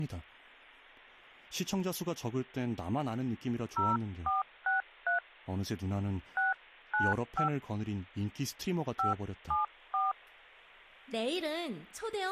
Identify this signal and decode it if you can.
DTMF, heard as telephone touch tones, dialled by hand, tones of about 150 ms, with speech in Korean. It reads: 0463 695 574